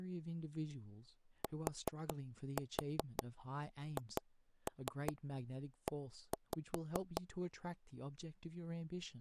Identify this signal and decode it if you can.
Tap code, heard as knocks on wood, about 5 knocks a second, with speech in English. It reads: THE